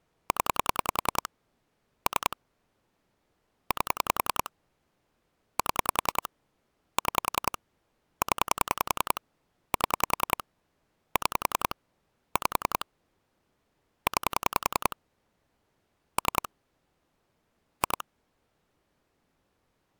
Pulse dialling, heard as clicks on a phone line, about 10 pulses a second. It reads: 0 3 8 7 6 0 7 6 5 9 3 2